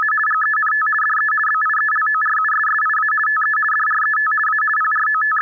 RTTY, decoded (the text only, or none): … GENT DE BIELORUSSIA TE DRET A …